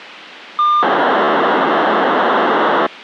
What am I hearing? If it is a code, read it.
POCSAG pager data (2400 baud), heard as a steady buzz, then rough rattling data, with radio hiss.